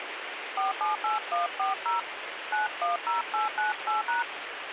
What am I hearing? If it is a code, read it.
DTMF, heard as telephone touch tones, dialled by hand, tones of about 140 ms, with radio hiss. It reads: 478140 910898#